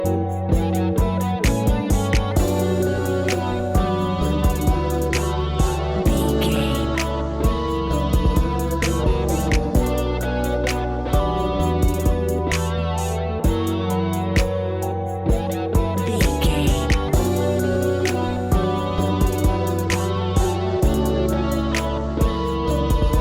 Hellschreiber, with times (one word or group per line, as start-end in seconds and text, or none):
none